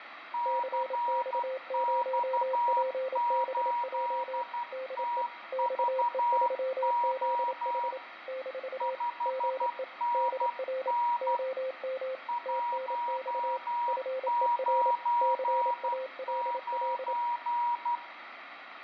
Morse code, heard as two keyed tones, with radio static. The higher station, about 12 wpm, 960 Hz: CX8TVO 5NN 199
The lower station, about 27 wpm, 520 Hz: CX0PBJ DE XE3ZH - GE DR OM TNX FER CALL